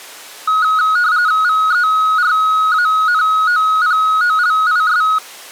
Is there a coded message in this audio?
Yes: RTTY (45.45 baud, 170 Hz shift) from 0.5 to 5.2 s, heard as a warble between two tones, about 1360 Hz centre. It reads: VERANOPOLIS